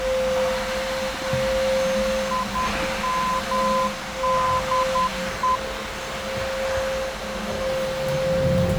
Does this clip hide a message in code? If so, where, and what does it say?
Yes: Morse code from 2.3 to 5.6 s, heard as a keyed tone, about 10 wpm, 1020 Hz, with radio static, a narrow filter and the noise inside a lift. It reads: IMDE